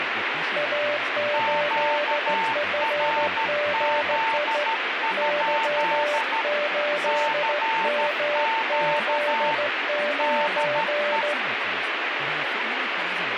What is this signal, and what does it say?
Morse code, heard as two keyed tones, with radio static and speech in English. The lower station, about 15 wpm, 590 Hz: A8FGI Y8MZ9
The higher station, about 13 wpm, 900 Hz: QRZ? CQ DE